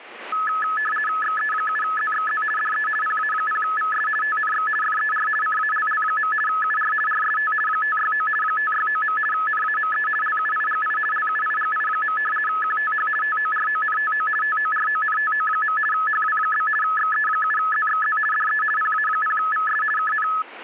RTTY (50 baud, 450 Hz shift), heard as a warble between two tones, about 1500 Hz centre. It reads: XE7ZXZ DE PA0VS TNX FER CALL. UR RST 569 569. NAME LUIGI LUIGI. QTH TORONTO TORONTO. HW? XE7ZXZ DE PA0VS KN